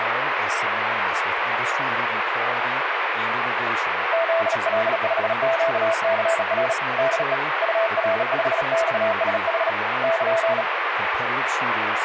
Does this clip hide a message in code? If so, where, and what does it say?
Yes: Morse code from 4.1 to 10.7 s, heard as a keyed tone, hand-sent with a bug key, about 37 wpm, 660 Hz, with radio static and speech in English. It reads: ZL5QCR DE UR5XSH <KN>